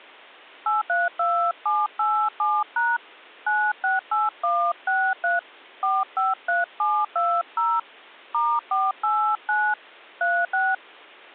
DTMF, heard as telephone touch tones, dialled by hand, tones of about 240 ms. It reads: 832787# 968163 453720 *489 36